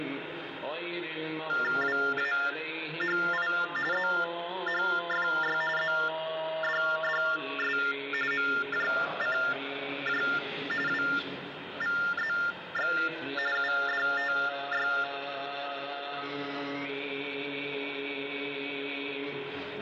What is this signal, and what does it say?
TTY/TDD text telephone tones (45.45 baud Baudot), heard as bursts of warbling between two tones, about 400 Hz shift, 1600 Hz centre, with phone line noise. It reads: WAHI ZHFY ZDDS MJCJ WVZX UDTY